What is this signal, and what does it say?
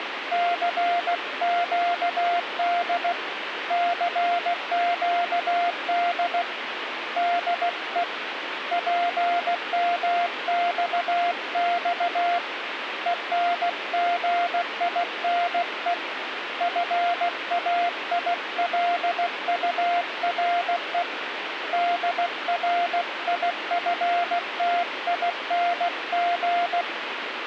Morse code, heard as a keyed tone, hand-sent with a paddle, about 16 wpm, 700 Hz, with radio static. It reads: CQD CQD DE PMXX ENGINE FAILURE DRIFTING